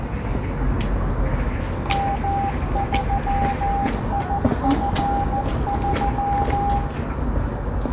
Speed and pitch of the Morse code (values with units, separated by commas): 14 wpm, 800 Hz